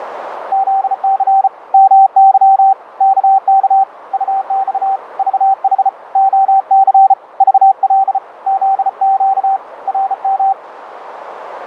Morse code, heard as a keyed tone, hand-sent with a bug key, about 34 wpm, 780 Hz, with radio static and a narrow filter. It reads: ZC MY KK UX VH OC VL ZQ RM